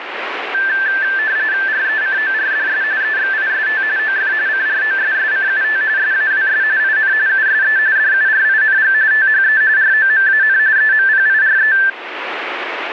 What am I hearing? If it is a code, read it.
RTTY (45.45 baud, 170 Hz shift), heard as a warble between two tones, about 1650 Hz centre, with radio static. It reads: RECORDS EXIST OF CROSSCUT SAWS IN USE DURING THE ROMAN EMPIRE